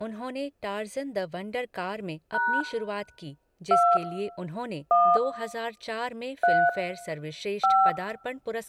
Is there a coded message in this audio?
Yes: DTMF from 2.3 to 7.9 s, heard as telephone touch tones, dialled by hand, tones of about 260 ms, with room echo and speech in Hindi. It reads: # 2 1 3 5